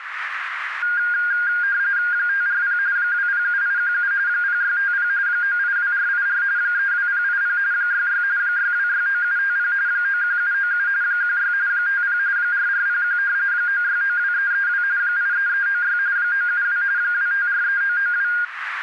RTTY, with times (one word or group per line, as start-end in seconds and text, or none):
2.1-2.8 540
3.0-4.1 207817
4.3-5.1 0650
5.3-6.4 982484
6.6-7.6 32080
7.7-8.2 66
8.4-9.7 6269750
9.9-10.9 91797
11.0-11.5 16
11.7-12.2 50
12.4-13.2 4401
13.5-14.8 9692332
15.0-16.0 83396
16.2-16.8 972
17.0-18.3 2543992